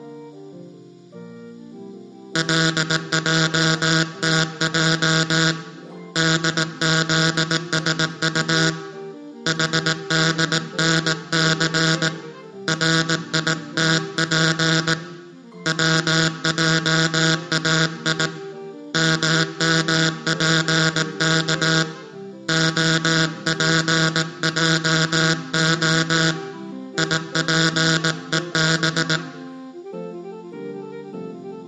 Morse code (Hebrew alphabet), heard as a buzzer, hand-sent with a paddle, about 18 wpm, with room echo. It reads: לעתע דזשט חדנס ריתף צעאי ממפך הפעה יפוב